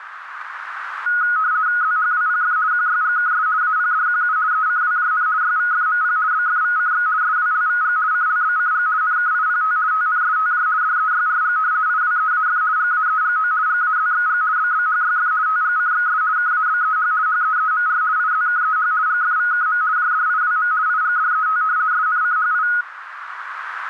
RTTY (50 baud, 170 Hz shift), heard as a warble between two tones, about 1360 Hz centre, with radio static and a narrow filter. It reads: ZHWPF QYGKS APDQU ECWJN YVFMP BFVCX SWLVG CLBCG NKIPT TNSTJ DEYRG IWEAF GAEGO GAZXG BBHYF TGCXS KABEH HEEMR IZKEH GFVKM JDIWM IGDET SNCHI